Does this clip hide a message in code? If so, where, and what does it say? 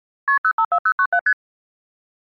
Yes: multi-frequency trunk signalling (R1, as on North American trunks) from 0.3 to 1.3 s, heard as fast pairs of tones, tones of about 70 ms. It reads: KP 054097 ST